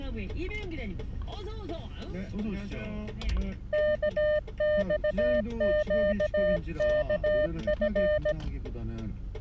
Morse code, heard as a keyed tone, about 17 wpm, 600 Hz, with the noise inside a car. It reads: KXQKF